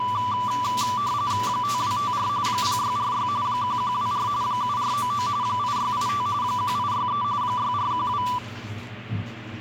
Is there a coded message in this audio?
Yes: RTTY (45.45 baud, 170 Hz shift) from 0.0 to 8.4 s, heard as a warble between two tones, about 1080 Hz centre, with the noise of a restroom. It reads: 5254 0646 1124 7499 8685 1863 6412